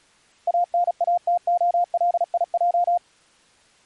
Morse code (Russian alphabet), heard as a keyed tone, machine-sent, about 36 wpm, 700 Hz. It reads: АНАТОЛИЙ